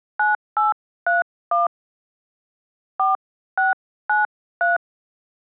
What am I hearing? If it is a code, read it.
DTMF, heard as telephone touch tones, dialled by hand, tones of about 160 ms. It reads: 9831 4693